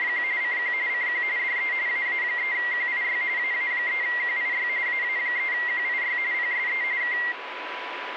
RTTY (45.45 baud, 170 Hz shift), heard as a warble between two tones, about 2000 Hz centre, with radio static and a steady whistle near 990 Hz. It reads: … CQ CQ DE AA3QIY AA3QIY AA3QIY PSE K